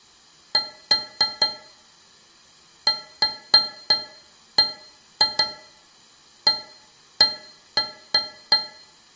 Irregular taps on a metal pipe, with room echo. There is no code.